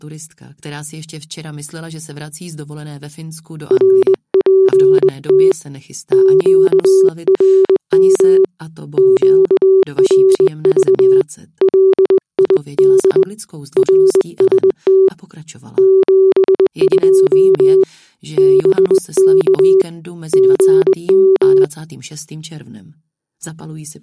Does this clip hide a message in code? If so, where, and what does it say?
Yes: Morse code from 3.6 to 21.7 s, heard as a keyed tone, hand-sent with a straight key, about 20 wpm, 380 Hz. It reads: RPT QRM QRV LID RST 72 BK GM